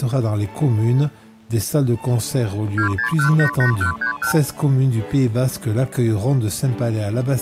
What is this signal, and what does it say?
Multi-frequency trunk signalling (R2, with the far end's replies), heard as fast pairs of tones, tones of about 100 ms. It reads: 26188131